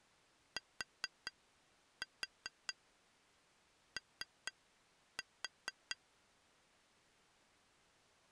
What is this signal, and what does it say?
Tap code, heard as taps on glass, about 4 knocks a second. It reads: TO